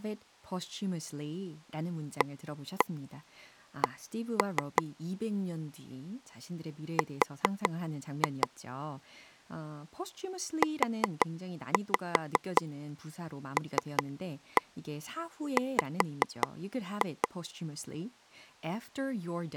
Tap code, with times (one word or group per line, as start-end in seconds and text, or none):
2.2-4.8 AC
7.0-8.5 R
10.6-17.3 ULW